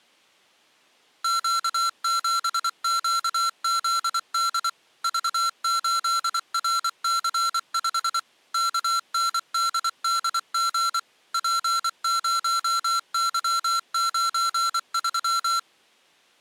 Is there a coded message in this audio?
Yes: Morse code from 1.2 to 15.7 s, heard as electronic beeps, machine-sent, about 24 wpm, 1360 Hz. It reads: Q7QZD V8RC5 KNDDG P0Y93